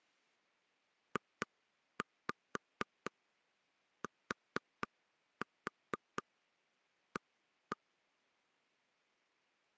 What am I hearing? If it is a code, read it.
Tap code, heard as taps on a table, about 4 knocks a second. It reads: JTA